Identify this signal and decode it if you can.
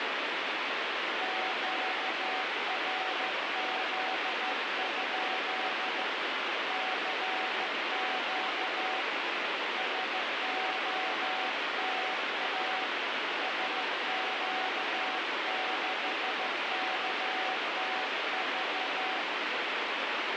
Morse code, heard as a keyed tone, hand-sent with a straight key, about 14 wpm, 750 Hz, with heavy radio static. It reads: QRZ? CQ SOTA SQ6KTV